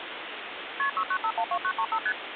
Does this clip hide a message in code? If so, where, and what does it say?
Yes: multi-frequency trunk signalling (R1, as on North American trunks) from 0.8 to 2.1 s, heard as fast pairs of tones, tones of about 70 ms, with phone line noise. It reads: KP 69512935 ST